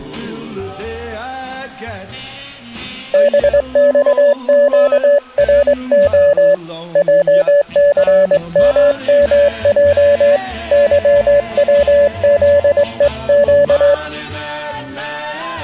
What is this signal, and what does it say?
Morse code, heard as a keyed tone, hand-sent with a straight key, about 21 wpm, 580 Hz. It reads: BXQRO JCMMJ YWZEQ